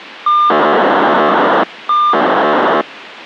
POCSAG pager data (2400 baud), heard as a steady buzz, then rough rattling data, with radio hiss.